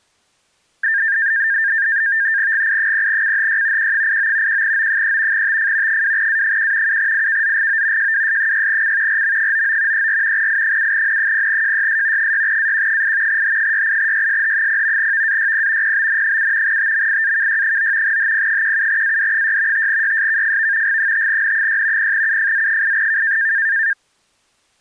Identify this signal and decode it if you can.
NAVTEX (SITOR-B), 100 baud, 170 Hz shift, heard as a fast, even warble, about 1700 Hz centre. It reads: GI0CHY Q89 1O3 TF 2A1 7IKZGO JWS6C RM99 34 I7N0JYS 6AQ8 H68YSH0 VAYP PBN7 TMIAKY9 HP17AD6 5YSKFV G5N6 0UFZ8K